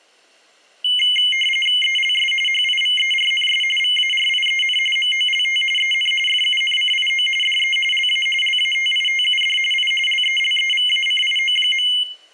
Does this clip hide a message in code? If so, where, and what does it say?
Yes: RTTY (45.45 baud, 850 Hz shift) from 0.8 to 12.0 s, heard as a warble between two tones, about 2550 Hz centre, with room echo. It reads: ELS HIVERNS VARIEN MOLT EN FUNCIO DE LA LATITUD I LELEVACIO.